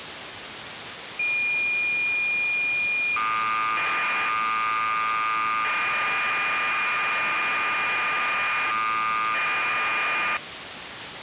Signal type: cassette data (Kansas City type)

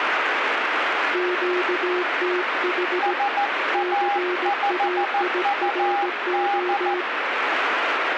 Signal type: Morse code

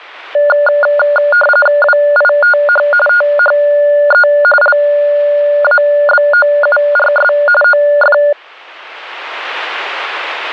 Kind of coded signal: RTTY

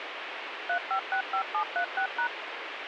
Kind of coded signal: DTMF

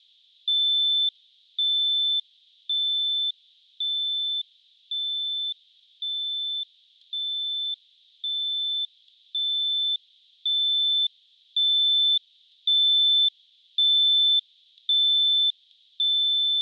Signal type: none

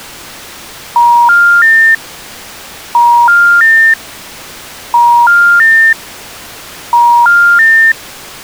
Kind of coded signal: telephone call progress tone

